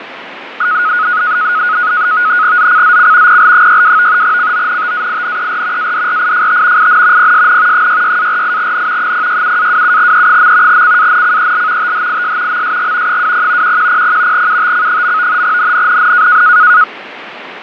NAVTEX (SITOR-B), 100 baud, 170 Hz shift, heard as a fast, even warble, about 1360 Hz centre, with radio static and fading. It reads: ZCZC PL62 CONTAINER ADRIFT IN PSN 66-48N 067-27E. CANCEL THIS MSG 20 1100 UTC. NNNN